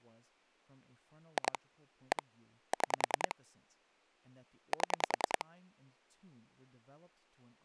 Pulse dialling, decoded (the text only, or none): 2 1 6 7